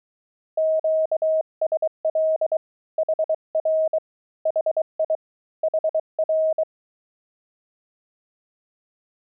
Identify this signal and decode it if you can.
Morse code, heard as a keyed tone, hand-sent with a bug key, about 23 wpm, 630 Hz. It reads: QSL HR HI HR